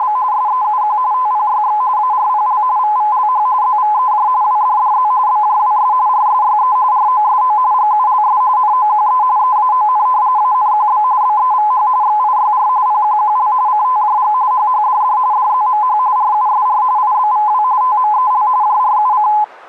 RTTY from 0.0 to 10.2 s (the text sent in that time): … SEUQ TPYX ARPL VVLH ZVEJ WDDZ BJWS RSYE ROSO GULS NOQE EAON